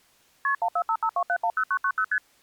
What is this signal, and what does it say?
Multi-frequency trunk signalling (R1, as on North American trunks), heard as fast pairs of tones, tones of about 70 ms. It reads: KP 14552710990 ST